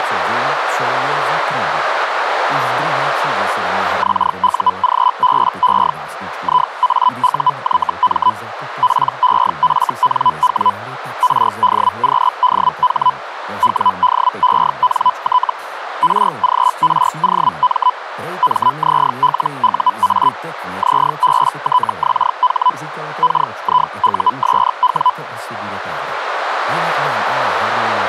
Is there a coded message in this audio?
Yes: Hellschreiber (Feld-Hell, 122.5 baud) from 4.0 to 25.1 s, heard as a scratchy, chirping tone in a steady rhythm, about 1000 Hz, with radio static. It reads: XUGBE IAUYM PEFNW RDQDH WDENT RGROM MZLUA ZBTXH KIUSW